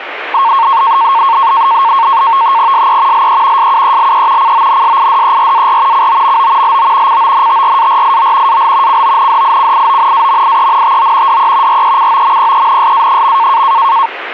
NAVTEX (SITOR-B), 100 baud, 170 Hz shift, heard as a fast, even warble, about 1000 Hz centre, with radio static. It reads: SE LE SUELE CONSIDERAR COMO LO CONTRARIO AL CONDICIONAMIENTO DE RECOMPENSA.